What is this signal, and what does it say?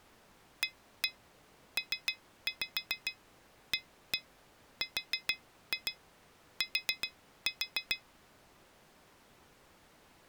Tap code, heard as taps on glass, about 7 knocks a second. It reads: APART